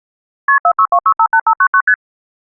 Multi-frequency trunk signalling (R1, as on North American trunks), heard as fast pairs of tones, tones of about 70 ms. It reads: KP 462658599 ST